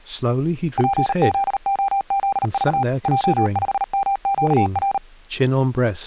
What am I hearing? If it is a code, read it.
Morse code, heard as a keyed tone, machine-sent, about 38 wpm, 790 Hz, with speech in English. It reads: PZOZV J5MQR